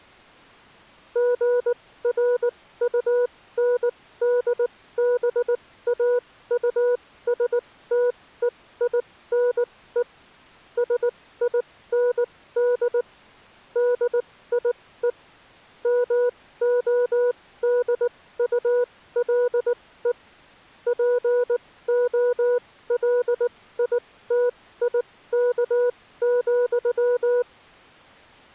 Morse code, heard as a keyed tone, machine-sent, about 19 wpm, spaced as for 15 wpm, 490 Hz. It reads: GRUNDBAUSTEINE SIND DIE MODULE POLITIK,